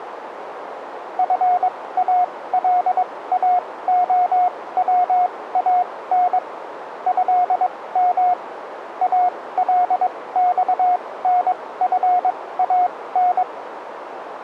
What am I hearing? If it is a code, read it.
Morse code (Arabic alphabet), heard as a keyed tone, machine-sent, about 22 wpm, spaced as for 17 wpm, 720 Hz, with radio static and a narrow filter. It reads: فالاخوان هم الصنفان